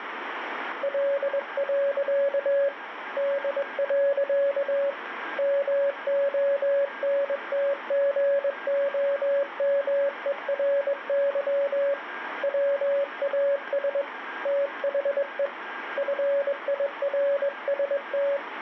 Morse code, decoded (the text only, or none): L. D. MONTGOMERY WAS THE FIRST